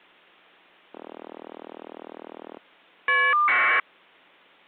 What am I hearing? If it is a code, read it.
Caller ID data burst, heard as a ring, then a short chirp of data, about 1200 baud.